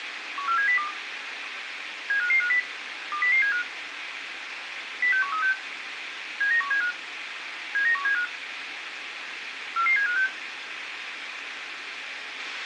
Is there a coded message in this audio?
Yes: five-tone selective call (CCIR) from 0.4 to 10.3 s, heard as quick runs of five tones, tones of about 100 ms, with radio hiss. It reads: 14702 75550 20075 06136 79175 79175 44756